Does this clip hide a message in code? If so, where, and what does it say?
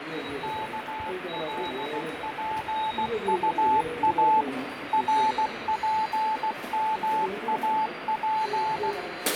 Yes: Morse code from 0.4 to 9.0 s, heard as a keyed tone, machine-sent, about 16 wpm, 870 Hz, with radio static, fading and the noise of a subway station. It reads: KLPUA RPMAP